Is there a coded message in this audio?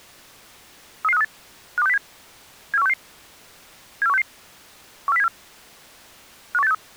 Yes: five-tone selective call (EEA) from 1.0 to 6.7 s, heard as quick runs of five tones, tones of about 40 ms. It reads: 33538 52607 74166 74166 14074 51863